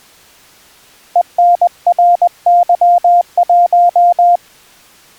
Morse code, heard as a keyed tone, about 20 wpm, 700 Hz. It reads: ENRY1